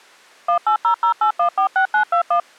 DTMF, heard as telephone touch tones, dialled by machine, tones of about 100 ms. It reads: 18008146921